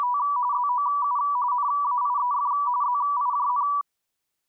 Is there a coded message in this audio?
Yes: RTTY (45.45 baud, 170 Hz shift) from 0.0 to 3.8 s, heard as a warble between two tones, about 1070 Hz centre. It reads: … ZOU NAIEF ZIJN